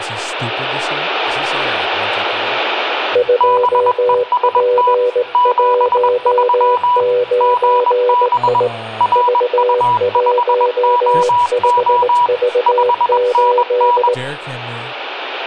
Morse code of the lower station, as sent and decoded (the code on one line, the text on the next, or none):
..--- .--. .---- ----. .. / ...- .---- ..... ...- ---..
2P19I V15V8